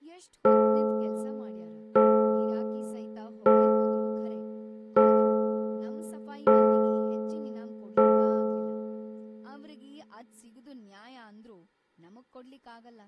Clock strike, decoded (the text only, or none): 6